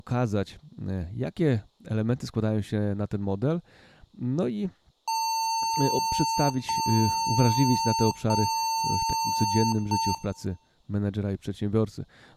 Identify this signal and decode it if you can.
Beep code, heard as beeps from a small speaker, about 900 Hz, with room echo and speech in Polish. 3 long, 1 short.